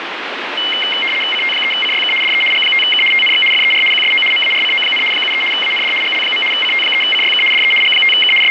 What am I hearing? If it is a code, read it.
RTTY (75 baud, 850 Hz shift), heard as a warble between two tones, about 2550 Hz centre, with radio static. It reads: CT3CYK DE G5K TNX FER QSO MARCO, 73 AND GL. CT3CYK DE G5K …